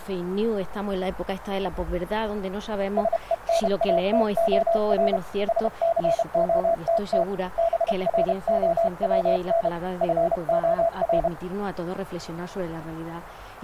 Morse code, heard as a keyed tone, hand-sent with a paddle, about 31 wpm, 670 Hz. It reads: SENATOR SCOTT BROWN FOR